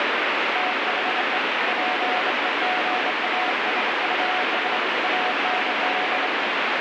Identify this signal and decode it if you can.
Morse code, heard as a keyed tone, hand-sent with a straight key, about 25 wpm, 740 Hz, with heavy radio static. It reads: THE PEGASUS AND